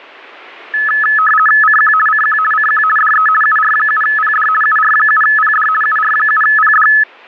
RTTY (50 baud, 450 Hz shift), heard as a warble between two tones, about 1500 Hz centre. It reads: CQ CQ CQ DE UR7PD UR7PD UR7PD